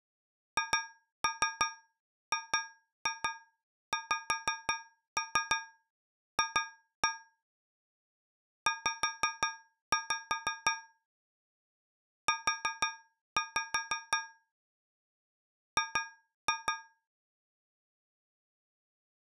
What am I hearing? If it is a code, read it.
Tap code, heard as taps on a metal pipe, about 5 knocks a second. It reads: HGXF Z U G